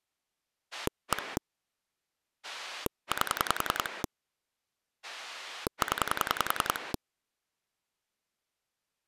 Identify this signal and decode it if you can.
Pulse dialling, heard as a rotary dial, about 10 pulses a second. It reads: 1 8 0